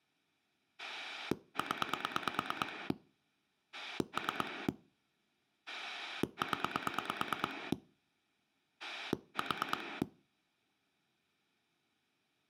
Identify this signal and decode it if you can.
Pulse dialling, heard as a rotary dial, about 9 pulses a second. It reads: 0 3 0 4